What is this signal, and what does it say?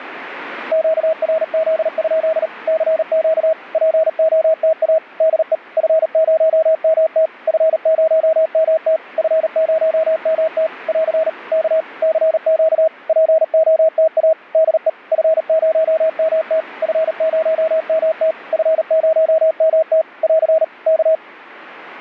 Morse code, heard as a keyed tone, machine-sent, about 38 wpm, 640 Hz. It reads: QRZ? CQ POTA DE F0MT F0MT F0MT <AR> K CQ POTA DE F0MT F0MT F0MT <AR> K